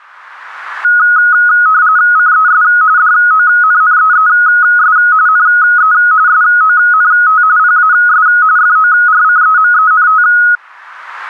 RTTY (45.45 baud, 170 Hz shift), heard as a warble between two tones, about 1360 Hz centre. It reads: CES DONNEES NE SONT PAS FORCEMENT